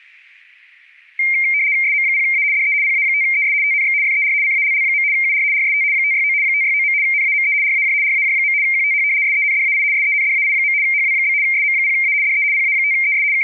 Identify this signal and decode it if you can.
RTTY (75 baud, 170 Hz shift), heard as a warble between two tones, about 2200 Hz centre. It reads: SM0A DE PA5ES TNX FER CALL. UR RST 569 569. NAME RAJ RAJ. QTH SENDAI SENDAI. HW? SM0A DE PA5ES …